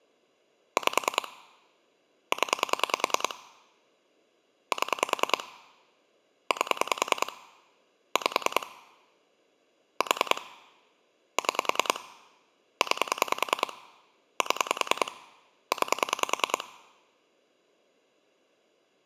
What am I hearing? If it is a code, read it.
Pulse dialling, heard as clicks on a phone line, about 10 pulses a second. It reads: 5 0 7 8 5 4 6 9 7 9